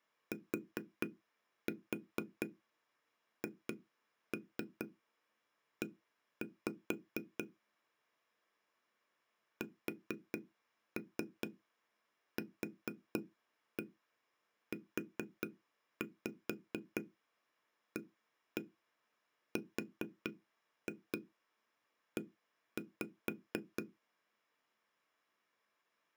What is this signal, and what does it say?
Tap code, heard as taps on a table, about 4 knocks a second. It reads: THE SQUARE